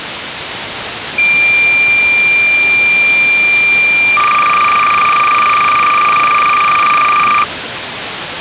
Cassette data (Kansas City type), 300 baud, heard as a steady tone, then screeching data, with tape hiss.